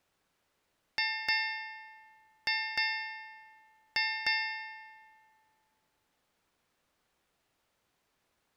Ship's bell, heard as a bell. 6. Six half-hours of the watch have passed.